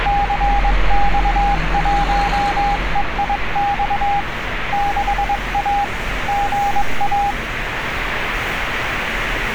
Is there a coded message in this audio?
Yes: Morse code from 0.0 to 7.4 s, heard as a keyed tone, hand-sent with a paddle, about 22 wpm, 810 Hz, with radio static and street noise. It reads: CX1EIX 6A GA